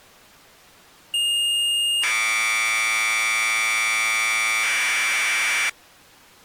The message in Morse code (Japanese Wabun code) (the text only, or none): none